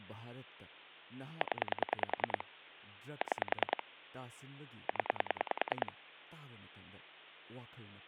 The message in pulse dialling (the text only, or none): 0 6 0